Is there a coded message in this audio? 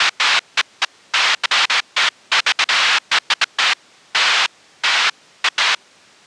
No, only bursts of noise.